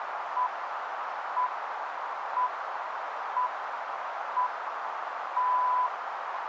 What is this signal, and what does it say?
Radio time signal (six pips, as the Greenwich Time Signal), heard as pips, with radio static and a narrow filter.